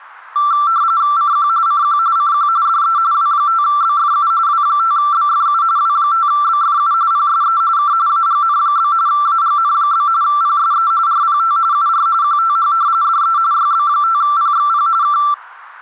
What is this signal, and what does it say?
RTTY (45.45 baud, 170 Hz shift), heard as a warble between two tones, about 1260 Hz centre. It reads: CQ CQ CQ DE W5BFU W5BFU W5BFU PSE K AGN? AGN? PSE RPT UR QTH DE YB5PXP K